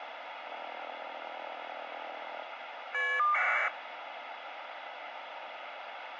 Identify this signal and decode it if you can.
Caller ID data burst, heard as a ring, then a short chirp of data, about 1200 baud, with phone line noise.